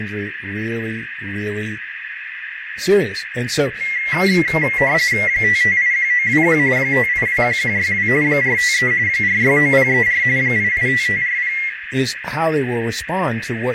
RTTY (45.45 baud, 170 Hz shift), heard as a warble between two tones, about 2050 Hz centre, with radio static, a narrow filter and speech in English. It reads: 5581921 5821162 453 469034 885540